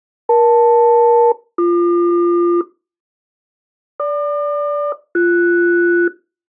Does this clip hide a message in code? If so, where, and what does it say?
Yes: aircraft SELCAL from 0.3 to 6.1 s, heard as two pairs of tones. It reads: EL-BQ GQ-BS